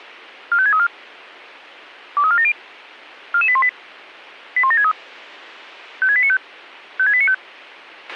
Five-tone selective call (ZVEI), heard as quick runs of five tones, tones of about 70 ms, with a squelch burst at the end. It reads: 45634 23470 44818 81763 56895 56895